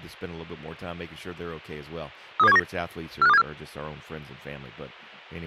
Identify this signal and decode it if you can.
Five-tone selective call (EEA), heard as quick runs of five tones, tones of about 40 ms, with speech in English. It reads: 32719 45274